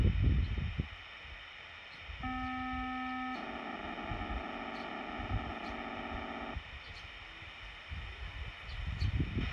POCSAG pager data (512 baud), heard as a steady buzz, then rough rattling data, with radio hiss, a squelch burst at the end and the noise of a park.